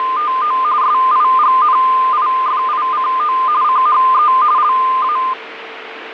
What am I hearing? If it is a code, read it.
RTTY (45.45 baud, 170 Hz shift), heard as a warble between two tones, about 1120 Hz centre, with radio static and a steady whistle near 450 Hz. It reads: … SIGNIFICO CHE LA